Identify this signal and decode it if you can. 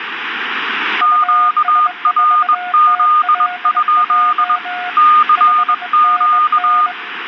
Morse code, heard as two keyed tones, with radio static and room echo. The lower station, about 22 wpm, 720 Hz: US4TLJ 5NN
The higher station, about 21 wpm, 1220 Hz: QRZ? CQ